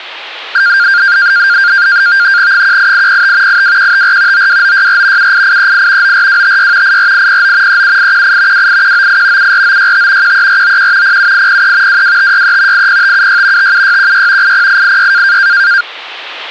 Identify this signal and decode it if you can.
NAVTEX (SITOR-B), 100 baud, 170 Hz shift, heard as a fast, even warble, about 1500 Hz centre. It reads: 18805 82154 92964 78838 94256 84809 37818 28198 74965 13491 07803 22563 80576 57616 80886